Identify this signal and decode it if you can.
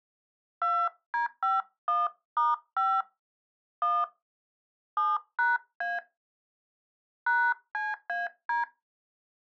DTMF, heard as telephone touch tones, dialled by hand, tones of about 190 ms. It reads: 2D51*5 1 7#A #CAD